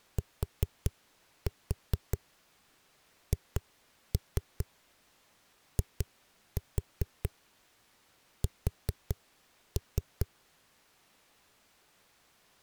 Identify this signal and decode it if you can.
Tap code, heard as knocks on a wall, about 4 knocks a second. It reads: THIS